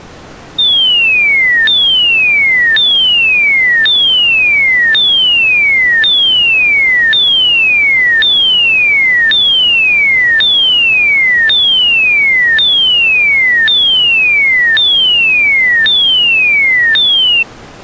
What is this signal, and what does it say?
A tone that sweeps in pitch again and again. There is no code.